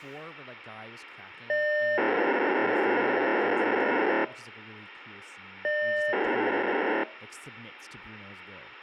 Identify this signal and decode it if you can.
POCSAG pager data (1200 baud), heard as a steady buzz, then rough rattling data, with speech in English.